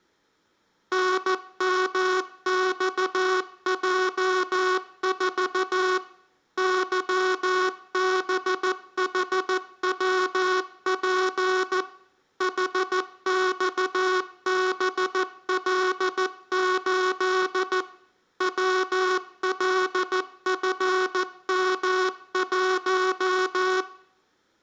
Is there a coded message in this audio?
Yes: Morse code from 0.9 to 23.9 s, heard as a buzzer, machine-sent, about 14 wpm. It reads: NMXJ4 YBHWP HXBL8 WLFM1